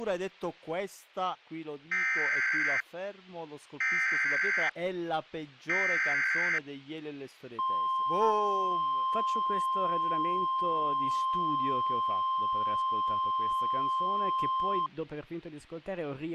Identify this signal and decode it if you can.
Emergency Alert System (SAME) tones (header bursts, then the 1050 Hz attention tone), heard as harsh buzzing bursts, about 520.83 baud, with speech in Italian.